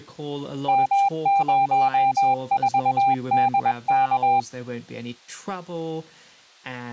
Morse code, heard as a keyed tone, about 21 wpm, 790 Hz, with speech in English. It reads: M04DK